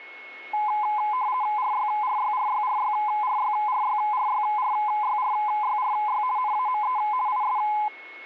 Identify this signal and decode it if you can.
RTTY (50 baud, 170 Hz shift), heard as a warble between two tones, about 930 Hz centre, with a steady whistle near 2180 Hz. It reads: RYRYRYRYRYRYRYRYRYRY NAME IS